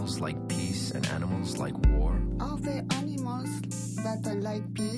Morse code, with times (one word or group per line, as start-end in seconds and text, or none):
none